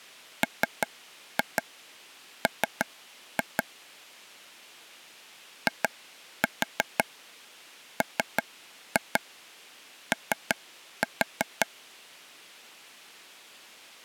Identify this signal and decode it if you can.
Tap code, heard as taps on a table, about 5 knocks a second. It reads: MM IMO